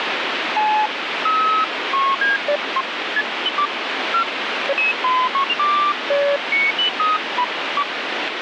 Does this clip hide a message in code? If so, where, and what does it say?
No, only electronic bleeps of random pitch and length, with radio static.